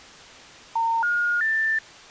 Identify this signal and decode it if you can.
Telephone call progress tone (North American plan), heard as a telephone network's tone, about 910, 1430, 1800 Hz. Special information tone.